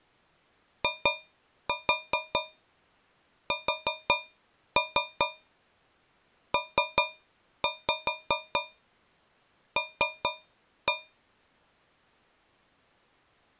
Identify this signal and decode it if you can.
Tap code, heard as taps on a metal pipe, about 5 knocks a second. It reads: ISPL